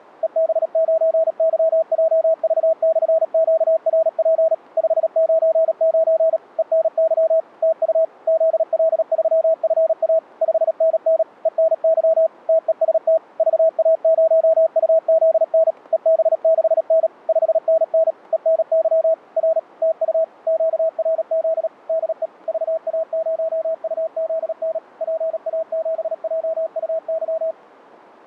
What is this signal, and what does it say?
Morse code, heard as a keyed tone, machine-sent, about 37 wpm, 650 Hz. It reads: EB9YJV/QRP 599 ENY TU ZL3FA 5NN ENY TEST VA0UZN EB6N 5NN ENY R TU QRZ DE VA0UZN PA7JUY